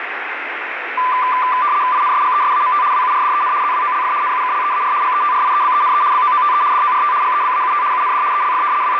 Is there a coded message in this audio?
Yes: RTTY (75 baud, 170 Hz shift) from 1.0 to 9.0 s, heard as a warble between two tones, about 1090 Hz centre, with radio static. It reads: INSGESAMT WURDEN ZWOLF NUKLEAR GETRIEBENE BOOTE DORT GEBAUT UND ELF …